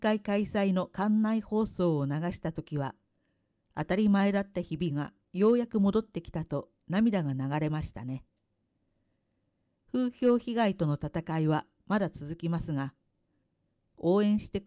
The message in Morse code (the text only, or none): none